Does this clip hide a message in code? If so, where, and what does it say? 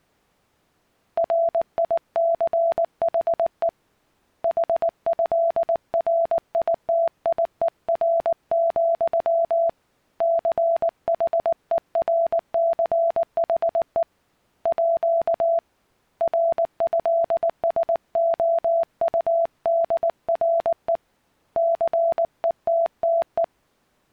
Yes: Morse code (with French letters) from 1.1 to 23.5 s, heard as a keyed tone, hand-sent with a paddle, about 19 wpm, 670 Hz. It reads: RICHE HÉRITIER, CHERCHE À RÉSOUDRE CETTE